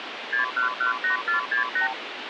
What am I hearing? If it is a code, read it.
Multi-frequency trunk signalling (R2, with the far end's replies), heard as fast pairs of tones, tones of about 120 ms, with phone line noise. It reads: 6118468